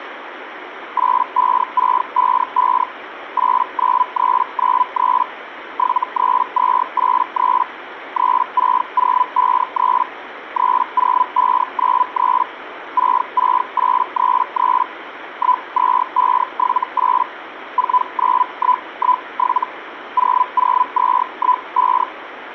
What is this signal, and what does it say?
Hellschreiber (Feld-Hell, 122.5 baud), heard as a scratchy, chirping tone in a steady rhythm, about 1000 Hz, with radio static. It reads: 85655 89393 73283 36053 30593 66833 12578 49117 00215